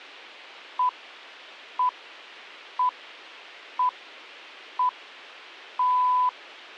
Radio time signal (six pips, as the Greenwich Time Signal), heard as pips.